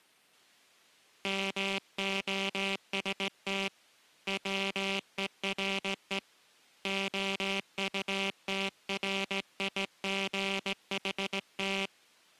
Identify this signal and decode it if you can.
Morse code, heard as a buzzer, hand-sent with a straight key, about 17 wpm. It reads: MOST WERE OUTRIGHT